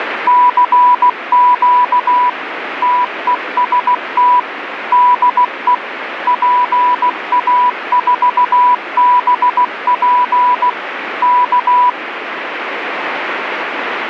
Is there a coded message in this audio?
Yes: Morse code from 0.2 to 12.0 s, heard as a keyed tone, machine-sent, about 16 wpm, 990 Hz, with radio static. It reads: CQ TEST DE PA4BP K